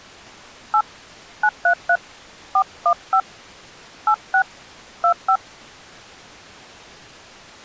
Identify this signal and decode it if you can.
DTMF, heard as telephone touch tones, dialled by hand, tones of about 80 ms. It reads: 8 933 415 86 25